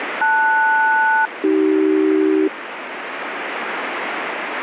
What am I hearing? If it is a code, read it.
Aircraft SELCAL, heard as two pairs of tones, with radio static. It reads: LS-AC